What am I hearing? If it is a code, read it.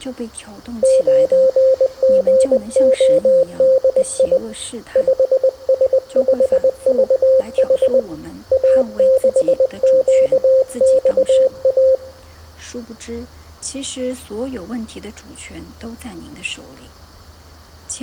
Morse code, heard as a keyed tone, hand-sent with a paddle, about 20 wpm, 530 Hz, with room echo. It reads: 9GODI 5S5VH A6QXA